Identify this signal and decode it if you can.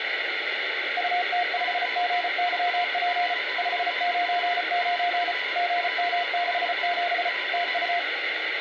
Morse code, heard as two keyed tones, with radio static and room echo. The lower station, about 34 wpm, 700 Hz: UT5GYP 599 GM67 TU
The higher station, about 35 wpm, 1000 Hz: ANT IS G5RV UP 25M SO